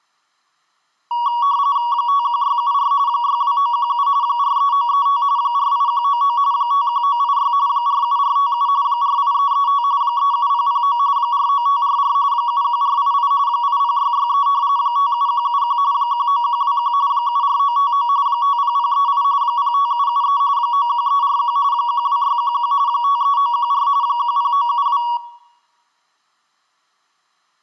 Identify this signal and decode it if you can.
RTTY (45.45 baud, 170 Hz shift), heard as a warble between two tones, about 1040 Hz centre, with room echo. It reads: 51674 62917 43935 48199 51986 47457 48335 37009 49544 71488 80663 57171 19121 74959 50038 05773 91341 12611 53914 10972